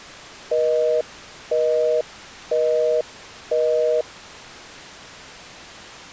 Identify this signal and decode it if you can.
Telephone call progress tone (North American plan), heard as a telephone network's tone, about 480, 620 Hz, 0.5 s on and 0.5 s off. Busy tone.